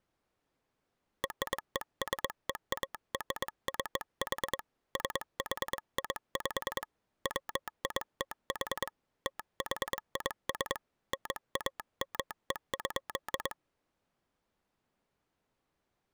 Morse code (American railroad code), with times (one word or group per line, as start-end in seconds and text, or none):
1.2-4.6 RESEARCH
5.0-6.8 SHIP
7.3-8.9 WITH
9.3-10.8 THIS
11.1-13.5 NAME.